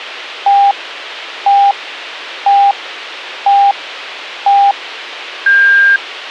Radio time signal (five pips and a higher one, as on Chinese radio), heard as pips.